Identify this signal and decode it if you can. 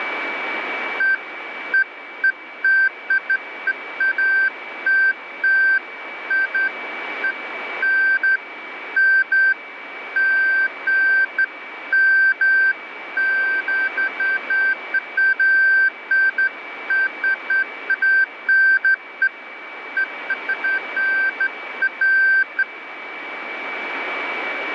Beeps of irregular length, with radio static and a steady whistle near 2290 Hz. There is no code.